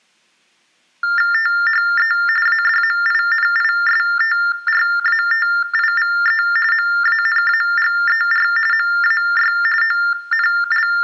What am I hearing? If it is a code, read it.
TTY/TDD text telephone tones (45.45 baud Baudot), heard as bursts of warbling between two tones, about 400 Hz shift, 1600 Hz centre, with room echo. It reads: THE ADMINISTRATIVE MANAGER MAY …